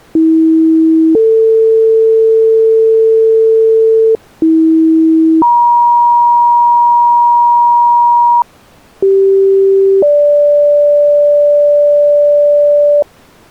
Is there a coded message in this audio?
Yes: two-tone page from 0.2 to 13.0 s, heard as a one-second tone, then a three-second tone, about 320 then 450 Hz, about 320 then 950 Hz, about 390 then 580 Hz.